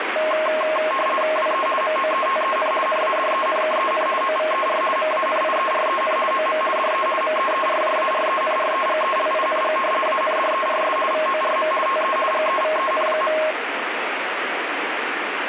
RTTY (50 baud, 450 Hz shift), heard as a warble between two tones, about 850 Hz centre, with radio static. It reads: WE MOETEN NADENKEN OVER MANIEREN OM DE MEERJARENREGELING ANDERS VORM TE GEVEN.